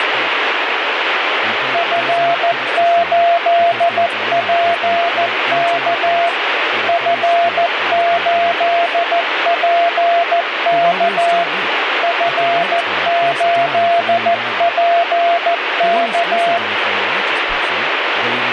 Morse code, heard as a keyed tone, machine-sent, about 14 wpm, 690 Hz, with radio static and speech in English. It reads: F8PK F8PK F8PK